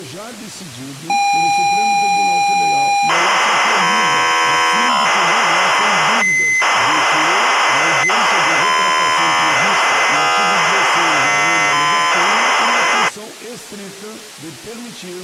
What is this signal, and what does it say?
ZX Spectrum tape loading, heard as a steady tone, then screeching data.